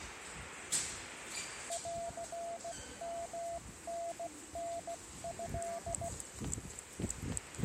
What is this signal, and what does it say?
Morse code (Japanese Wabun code), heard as a keyed tone, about 16 wpm, 680 Hz, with the noise of a subway station. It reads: ンヨタタト